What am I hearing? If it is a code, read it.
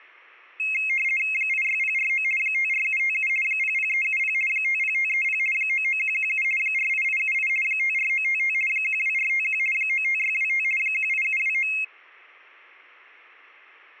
RTTY (50 baud, 450 Hz shift), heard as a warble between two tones, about 2350 Hz centre. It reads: 86049 54757 00370 50530 99117 48878 54955 12451 95625 18729